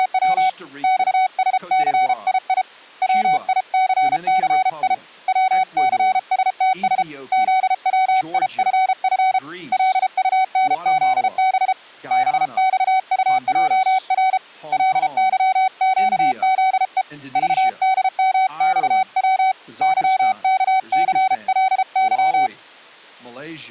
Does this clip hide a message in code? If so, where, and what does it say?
Yes: Morse code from 0.0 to 22.5 s, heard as a keyed tone, hand-sent with a paddle, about 33 wpm, 760 Hz, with speech in English. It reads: … XSCII WICCI WCSTS ZWIFF LUNZB BXUJR LYQZE VDMXW YKCLY